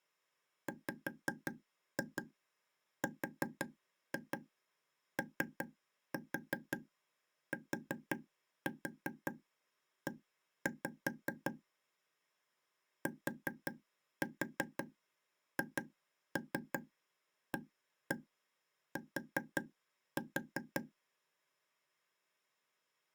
Tap code, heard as taps on a table, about 5 knocks a second. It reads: WROTE THAT